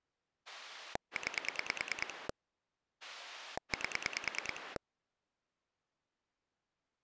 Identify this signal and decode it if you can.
Pulse dialling, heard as a rotary dial, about 9 pulses a second. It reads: 9 8